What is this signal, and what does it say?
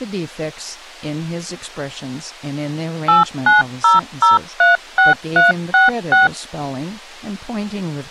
DTMF, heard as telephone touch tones, dialled by machine, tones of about 150 ms, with speech in English. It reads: 890036366